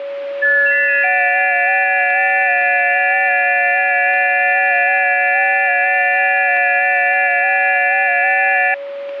FT8 (several signals at once), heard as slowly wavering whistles, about 6.25 baud, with a steady whistle near 560 Hz.